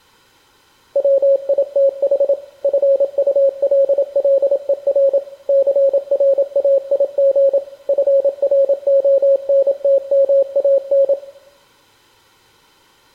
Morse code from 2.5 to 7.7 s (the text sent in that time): FULLER CRAIG